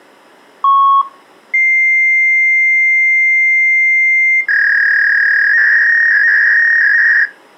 Fax machine handshake, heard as a long tone and a warble.